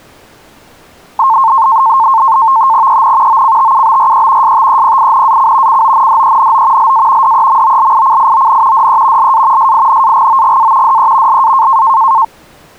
NAVTEX (SITOR-B), 100 baud, 170 Hz shift, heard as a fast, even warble, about 980 Hz centre. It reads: EN OCTUBRE STEPINAC CONDENO LA DEMOLICION DE LA SINAGOGA DE LA